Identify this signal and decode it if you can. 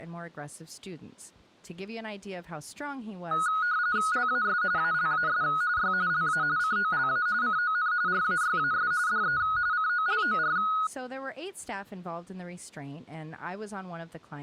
RTTY (45.45 baud, 170 Hz shift), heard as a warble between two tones, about 1360 Hz centre, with speech in English. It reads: LAS ALAS Y LA COLA CON RAYAS DE COLOR